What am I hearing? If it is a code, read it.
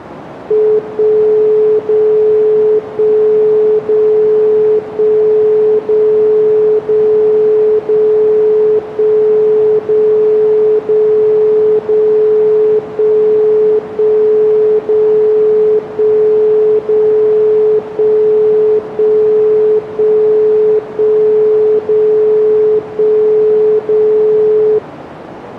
Radio time signal (DCF77), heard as a tone whose level steps once a second, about 430 Hz, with radio static. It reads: 1 0 1 0 1 0 0 0 1 0 0 0 1 1 0 1 0 1 1 1 1 0 1 0